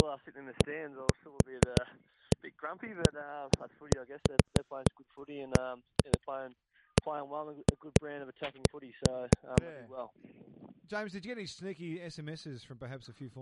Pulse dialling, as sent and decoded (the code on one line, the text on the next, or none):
none